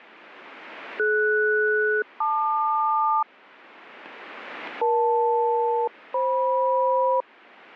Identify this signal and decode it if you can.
Aircraft SELCAL, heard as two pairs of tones. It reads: DS-LQ EL-FM